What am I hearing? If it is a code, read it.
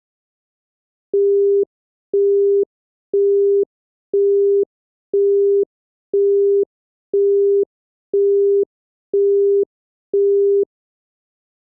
Telephone call progress tone (single-tone plan, as in Europe, Japan and elsewhere), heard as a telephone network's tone, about 400 Hz, 0.5 s on and 0.5 s off. Busy tone.